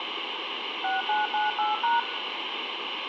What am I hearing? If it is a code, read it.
DTMF, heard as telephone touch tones, dialled by machine, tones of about 160 ms, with phone line noise and room echo. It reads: 6998#